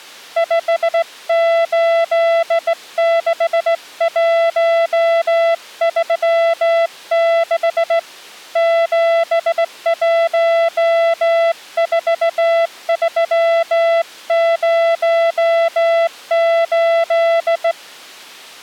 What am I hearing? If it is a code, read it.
Morse code, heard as a keyed tone, hand-sent with a straight key, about 17 wpm, 670 Hz. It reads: 586136 714308